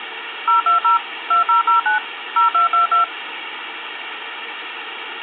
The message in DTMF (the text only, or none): 020 2009 0222